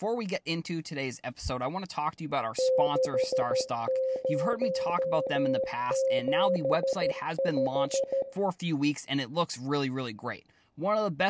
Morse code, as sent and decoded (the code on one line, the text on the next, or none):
-.... ----- --... .....
6075